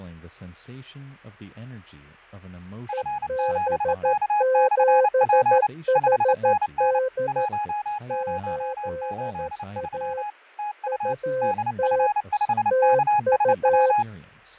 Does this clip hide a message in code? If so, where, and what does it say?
Yes: Morse code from 2.8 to 14.1 s, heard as two keyed tones, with fading. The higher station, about 29 wpm, 840 Hz: F7K/P 5NN 1083 TU DF5KSW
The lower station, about 13 wpm, 520 Hz: EB7HD 8A UT TU